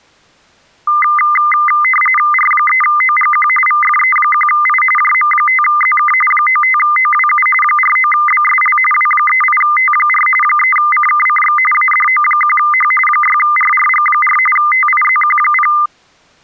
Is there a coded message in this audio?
Yes: RTTY (45.45 baud, 850 Hz shift) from 0.9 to 15.9 s, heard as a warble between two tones, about 1600 Hz centre. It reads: R3OGQ VFE1I JM5ZK 95OWU 49BSL W38T4 3CKCX ADO1H 6RRG4 TIZQ0